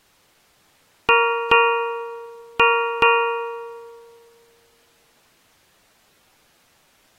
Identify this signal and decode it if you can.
Ship's bell, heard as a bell. 4. Four half-hours of the watch have passed.